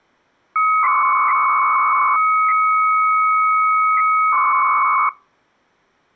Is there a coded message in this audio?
Yes: 300-baud modem data (Bell 103 tones) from 0.6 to 5.1 s, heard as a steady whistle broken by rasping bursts, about 300 baud, 200 Hz shift.